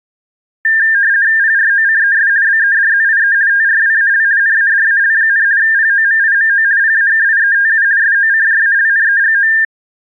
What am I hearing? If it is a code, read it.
RTTY (50 baud, 170 Hz shift), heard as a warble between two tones, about 1700 Hz centre. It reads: PROCES BEDZIE TRWAL NADAL, POMIMO PAKIETU SOCJALNEGO